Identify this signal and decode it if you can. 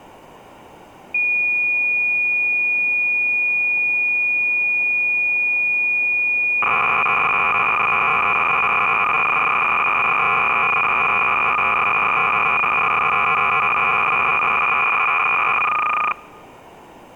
Cassette data (Kansas City type), 300 baud, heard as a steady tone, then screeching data.